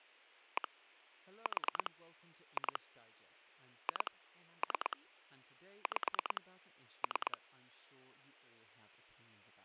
Pulse dialling, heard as clicks on a phone line, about 9 pulses a second, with speech in English. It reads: 1 4 2 2 3 5 3